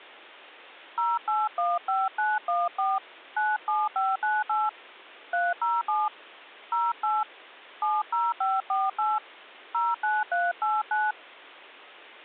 DTMF, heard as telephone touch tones, dialled by hand, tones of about 200 ms. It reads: 0815914 97598 307 08 70548 09389